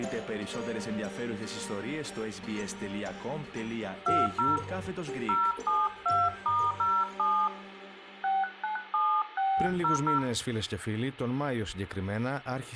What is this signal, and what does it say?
DTMF, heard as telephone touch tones, dialled by hand, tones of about 210 ms, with room echo. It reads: 20 072*07 697600